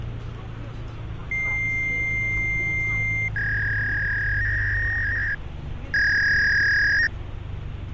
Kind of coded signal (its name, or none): fax machine handshake